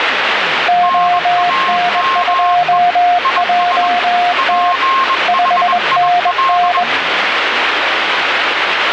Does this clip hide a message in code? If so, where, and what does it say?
Yes: Morse code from 0.6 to 6.9 s, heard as two keyed tones, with radio static and the noise inside a car. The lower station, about 21 wpm, 710 Hz: ON2JT 5NN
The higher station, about 21 wpm, 1070 Hz: NAME IS PHIL